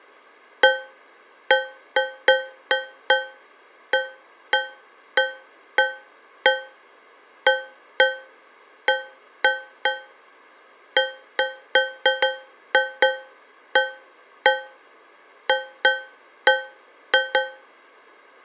Irregular taps on a metal pipe. There is no code.